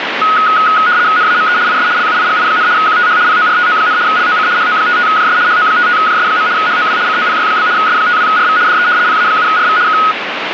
RTTY (75 baud, 170 Hz shift), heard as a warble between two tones, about 1360 Hz centre, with radio static. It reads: NAME IS LUIGI, QTH PORTO, LOC HO55JS HO55JS. HOW COPY? S52RV DE PA7RV K